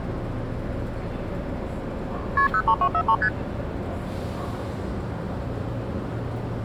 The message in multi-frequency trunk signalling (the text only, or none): KP 03243 ST